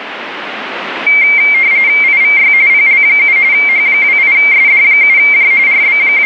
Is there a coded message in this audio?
Yes: RTTY (45.45 baud, 170 Hz shift) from 1.1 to 6.3 s, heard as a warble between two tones, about 2200 Hz centre, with radio static. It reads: IVY PL7 H28SD7J …